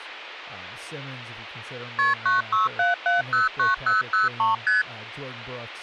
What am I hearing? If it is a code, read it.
Multi-frequency trunk signalling (R1, as on North American trunks), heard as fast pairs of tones, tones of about 150 ms, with speech in English. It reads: KP 967709003 ST